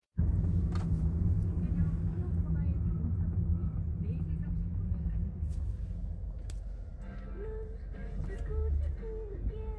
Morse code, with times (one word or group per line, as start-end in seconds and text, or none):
none